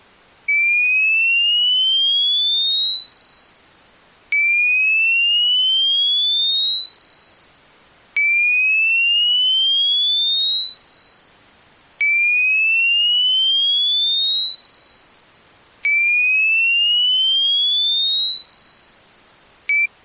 A tone that sweeps in pitch again and again. There is no code.